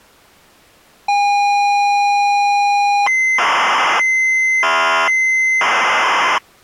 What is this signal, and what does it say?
ZX Spectrum tape loading, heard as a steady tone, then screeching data.